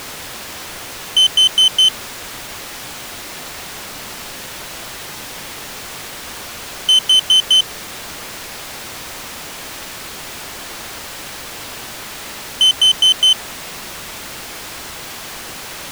Alarm pattern, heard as an alarm's beeps, played three times, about 3050 Hz. Temporal four. Carbon monoxide.